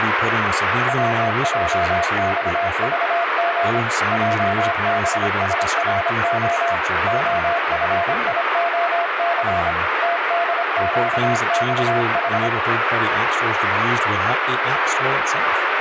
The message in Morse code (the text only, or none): WJXVG JBSRO OFIOC TDQXH